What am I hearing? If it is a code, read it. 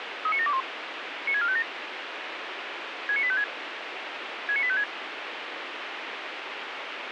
Five-tone selective call (ZVEI), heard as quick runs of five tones, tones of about 70 ms, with radio hiss. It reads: 39721 96457 69856 69856